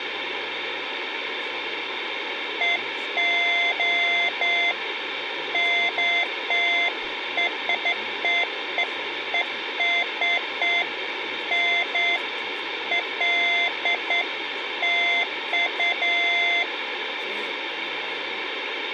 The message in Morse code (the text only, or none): none